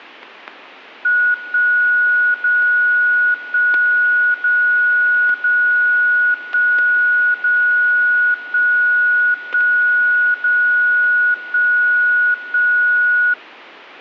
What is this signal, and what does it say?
Radio time signal (DCF77), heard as a tone whose level steps once a second, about 1460 Hz, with static crashes. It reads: 1 0 1 0 0 1 0 1 1 0 1 1